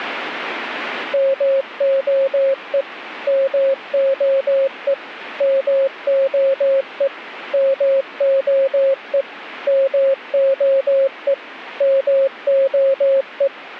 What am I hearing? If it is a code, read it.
Morse code, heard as a keyed tone, machine-sent, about 18 wpm, 540 Hz. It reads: MOE MOE MOE MOE MOE MOE